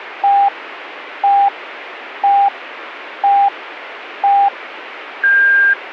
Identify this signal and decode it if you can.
Radio time signal (five pips and a higher one, as on Chinese radio), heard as pips, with radio static.